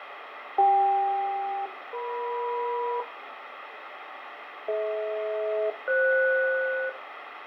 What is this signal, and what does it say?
Aircraft SELCAL, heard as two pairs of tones, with radio static and fading. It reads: CK-EM DH-FS